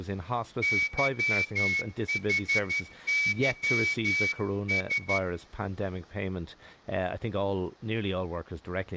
Morse code, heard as a whistle, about 12 wpm, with speech in English. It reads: YHYS